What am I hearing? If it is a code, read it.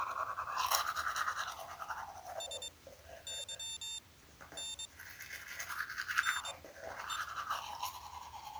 Morse code (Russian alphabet), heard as a high beeper, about 22 wpm, spaced as for 11 wpm, 3600 Hz, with the noise of a restroom. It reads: СЫН НЕ